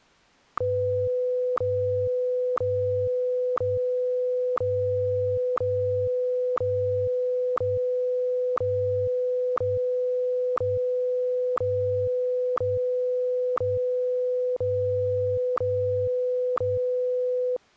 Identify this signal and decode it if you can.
Radio time signal (WWVH, Hawaii), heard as ticks, one a second.